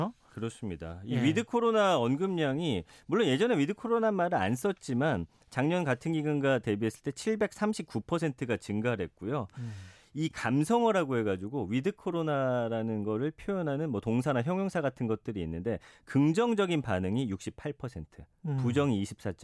Speech in Korean. There is no code.